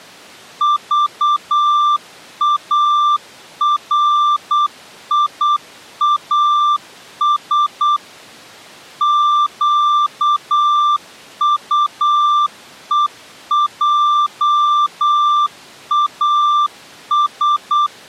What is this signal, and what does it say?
Morse code, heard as a keyed tone, machine-sent, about 8 wpm, 1180 Hz. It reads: VARIAS QUEJAS